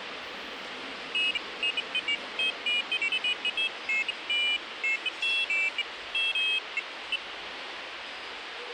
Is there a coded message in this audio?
No, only pairs of high tones at irregular times, with radio hiss and the noise of a subway station.